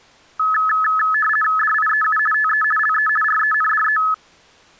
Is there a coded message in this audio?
Yes: RTTY (50 baud, 450 Hz shift) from 0.4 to 4.1 s, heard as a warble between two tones, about 1500 Hz centre. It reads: DIEU TE LE RENDE